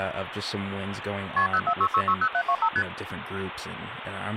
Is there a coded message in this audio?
Yes: multi-frequency trunk signalling (R1, as on North American trunks) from 1.4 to 2.8 s, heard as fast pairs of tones, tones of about 70 ms, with phone line noise and speech in English. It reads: KP 046660725 ST